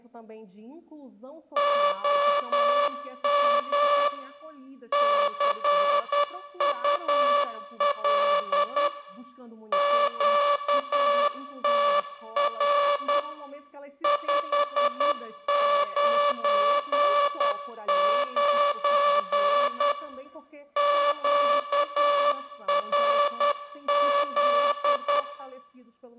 Morse code, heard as a buzzer, machine-sent, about 10 wpm, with room echo. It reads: OM CUL QTR 599 QRZ